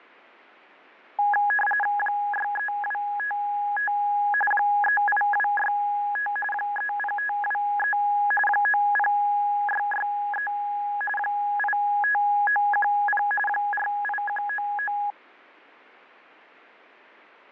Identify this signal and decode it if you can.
RTTY (45.45 baud, 850 Hz shift), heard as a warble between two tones, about 1250 Hz centre. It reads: 63255 38265 30523 90663 85910 48199